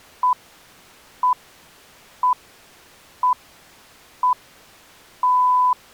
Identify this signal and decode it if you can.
Radio time signal (six pips, as the Greenwich Time Signal), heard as pips.